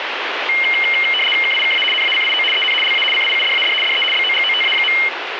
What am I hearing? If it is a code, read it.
RTTY (75 baud, 850 Hz shift), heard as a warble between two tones, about 2550 Hz centre, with radio static. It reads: KIKA NACIO EN LA CIUDAD DE BOGOTA.